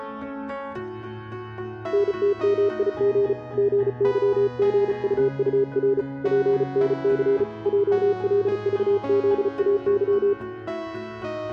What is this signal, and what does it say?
Morse code, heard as a keyed tone, hand-sent with a paddle, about 35 wpm, 400 Hz. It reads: NTMIG GYGUUR PNC JLVZAY